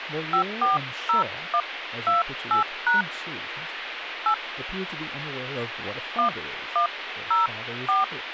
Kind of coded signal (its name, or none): DTMF